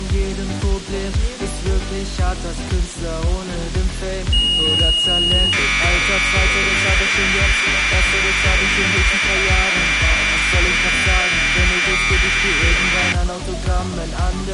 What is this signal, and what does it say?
Commodore tape loading (standard loader), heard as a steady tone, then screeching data.